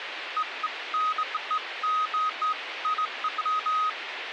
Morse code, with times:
none

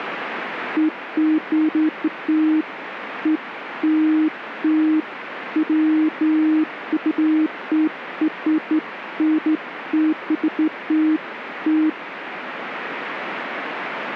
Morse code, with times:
none

